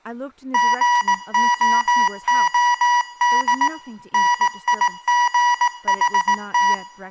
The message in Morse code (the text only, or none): GOOD NIGHT